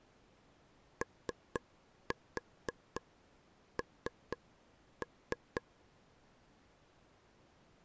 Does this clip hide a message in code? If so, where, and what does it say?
Yes: tap code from 1.0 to 5.6 s, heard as taps on a table, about 4 knocks a second. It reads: ON